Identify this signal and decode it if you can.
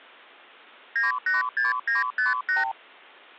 Multi-frequency trunk signalling (R2, with the far end's replies), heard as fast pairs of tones, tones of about 150 ms. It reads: 986958